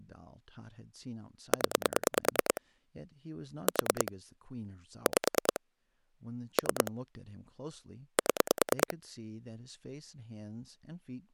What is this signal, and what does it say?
Pulse dialling, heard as clicks on a phone line, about 9 pulses a second, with speech in English. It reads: 0 4 5 3 7